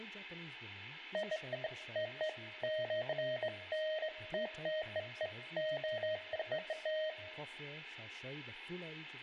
Beeps of irregular length, with a squelch burst at the end, room echo and speech in English. There is no code.